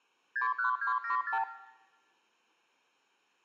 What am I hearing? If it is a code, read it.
Multi-frequency trunk signalling (R2, with the far end's replies), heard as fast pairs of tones, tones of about 110 ms, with room echo. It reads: 61274